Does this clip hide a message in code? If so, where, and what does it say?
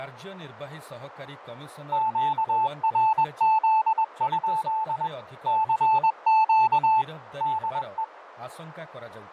Yes: Morse code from 1.9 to 8.1 s, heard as a keyed tone, machine-sent, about 21 wpm, 880 Hz, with radio static, fading and speech in Odia. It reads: QRZ? CQ DE